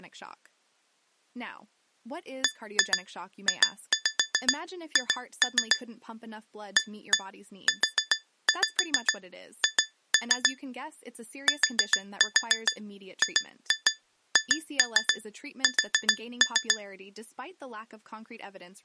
Tap code, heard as taps on glass, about 7 knocks a second, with speech in English. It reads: BJH AUH TGHS